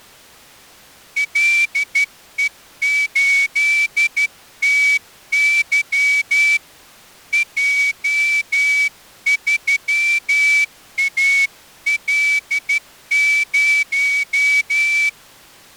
Morse code, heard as a whistle, hand-sent with a straight key, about 12 wpm. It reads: LE8TY J3AL0